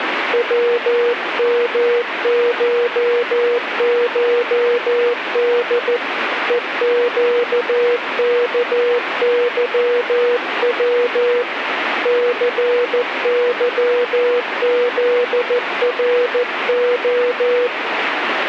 Morse code (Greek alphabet), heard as a keyed tone, hand-sent with a paddle, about 14 wpm, 480 Hz, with radio static. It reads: ΩΜΧΧΔ ΕΨΚΥΩ ΘΥΖΡΟ